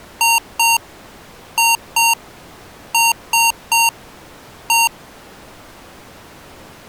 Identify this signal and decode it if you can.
Beep code, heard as beeps from a small speaker, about 920 Hz. 2-2-3-1. In Phoenix BIOS tables: unexpected interrupt.